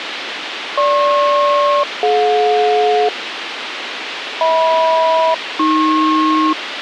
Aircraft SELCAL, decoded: GP-DJ HM-AP

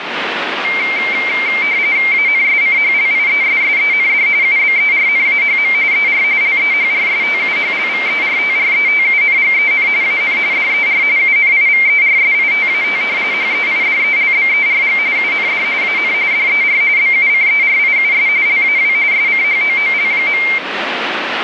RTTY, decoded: ANSCHLIESSEND UBERNAHM ER LEHRSTUHLVERTRETUNGEN AN DER UNIVERSITAT HEIDELBERG UND AN DER BUCERIUS LAW SCHOOL.

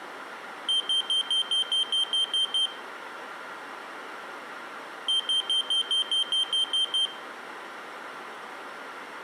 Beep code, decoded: 10 short

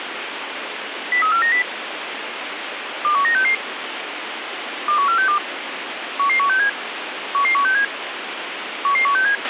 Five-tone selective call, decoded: 03490 21966 21462 11167 11167 11167

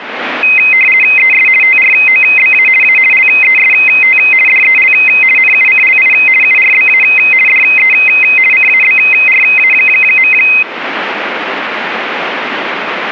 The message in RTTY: ES TROBA A LEST DEL NUCLI URBA DE CABRA.

